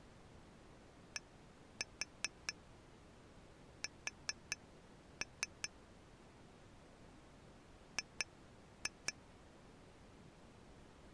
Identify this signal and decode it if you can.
Tap code, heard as taps on glass, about 4 knocks a second. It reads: DS G